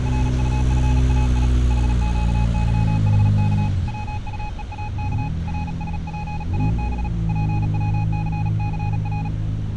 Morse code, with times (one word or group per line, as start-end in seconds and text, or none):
0.1-1.5 RUFAI
1.7-3.7 HQYHK
3.9-5.3 WUEAK
5.5-7.1 RSPAB
7.3-9.3 PWCCR